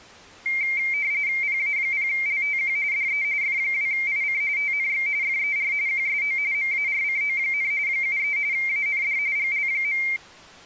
RTTY (45.45 baud, 170 Hz shift), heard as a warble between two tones, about 2200 Hz centre. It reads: PA0LTQ DE F2IC TNX FER QSO MARCO, 73 AND GL.